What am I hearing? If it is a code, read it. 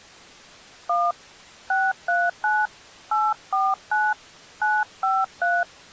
DTMF, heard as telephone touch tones, dialled by hand, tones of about 220 ms. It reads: 1 639 849 953